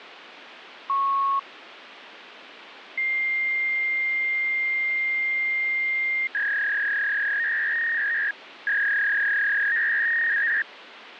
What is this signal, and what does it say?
Fax machine handshake, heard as a beep, a long tone and a warble, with phone line noise.